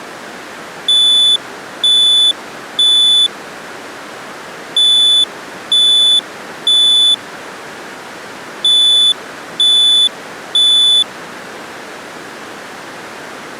Alarm pattern, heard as an alarm's beeps, played three times, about 3500 Hz. Temporal three. Smoke or fire, evacuate.